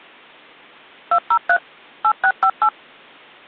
DTMF, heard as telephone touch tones, dialled by machine, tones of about 70 ms. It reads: 203 8658